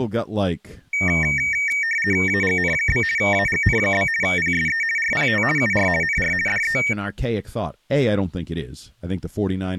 RTTY (50 baud, 450 Hz shift), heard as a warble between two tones, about 2050 Hz centre, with speech in English. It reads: AGN? AGN? PSE RPT UR NR DE